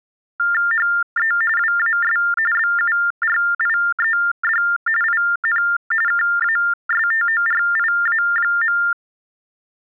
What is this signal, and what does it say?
TTY/TDD text telephone tones (45.45 baud Baudot), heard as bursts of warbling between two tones, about 400 Hz shift, 1600 Hz centre. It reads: HE WAS BURIED IN KASTORIA.